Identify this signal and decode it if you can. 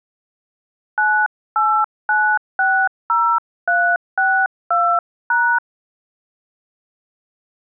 DTMF, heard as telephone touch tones, dialled by hand, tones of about 280 ms. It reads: 98960362#